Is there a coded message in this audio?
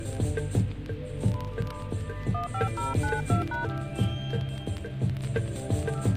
Yes: DTMF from 2.3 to 3.6 s, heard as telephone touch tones, dialled by hand, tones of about 130 ms. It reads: 15092#